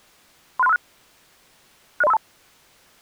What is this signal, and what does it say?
Five-tone selective call (EIA), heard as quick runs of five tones, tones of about 30 ms. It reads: 36356 60352